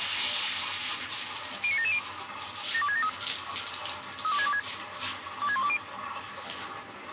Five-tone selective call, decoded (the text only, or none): 09770 72673 32626 26120